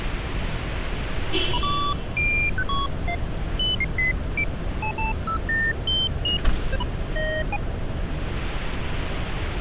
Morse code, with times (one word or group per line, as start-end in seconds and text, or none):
none